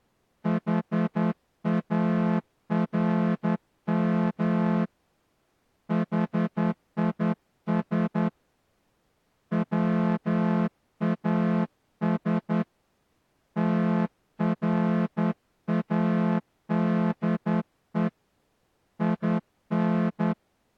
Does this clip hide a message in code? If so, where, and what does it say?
Yes: Morse code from 0.4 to 20.4 s, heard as a horn, hand-sent with a straight key, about 10 wpm. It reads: HARM HIS WAS TRADE IN